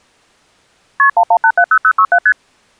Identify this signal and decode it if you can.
Multi-frequency trunk signalling (R1, as on North American trunks), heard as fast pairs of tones, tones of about 70 ms. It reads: KP 11870067 ST